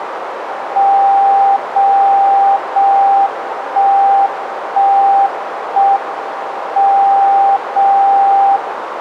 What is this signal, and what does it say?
Radio time signal (JJY), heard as a tone whose level steps once a second, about 790 Hz, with radio static and a narrow filter. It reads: 0 0 1 1 1 M 0 0